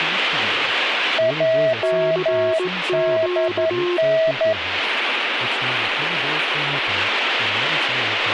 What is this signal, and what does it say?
Morse code, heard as two keyed tones, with radio static and speech in English. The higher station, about 11 wpm, 650 Hz: JDN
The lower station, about 18 wpm, 360 Hz: CQ